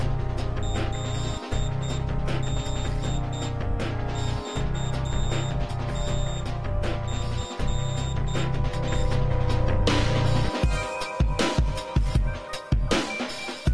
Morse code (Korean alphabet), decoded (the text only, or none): 그러나